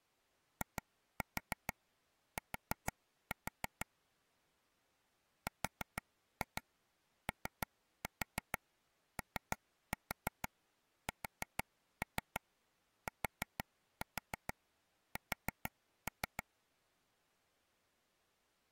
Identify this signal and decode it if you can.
Tap code, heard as taps on a table, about 6 knocks a second. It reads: IT ROOSTS